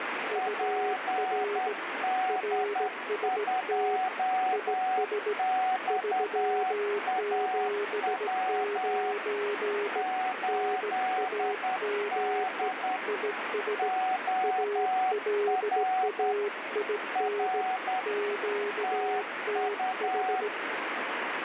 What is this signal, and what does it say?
Morse code, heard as two keyed tones, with heavy radio static. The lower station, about 17 wpm, 410 Hz: UR RST IS 379 NAME IS ALAIN QTH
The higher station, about 10 wpm, 750 Hz: PD2XAW 8D OR R TU